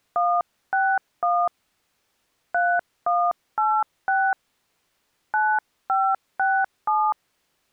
DTMF, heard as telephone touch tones, dialled by hand, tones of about 250 ms. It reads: 161 3186 9567